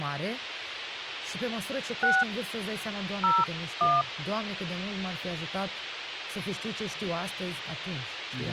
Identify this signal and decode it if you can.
DTMF, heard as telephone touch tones, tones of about 210 ms, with radio hiss and speech in Romanian. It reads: 6 01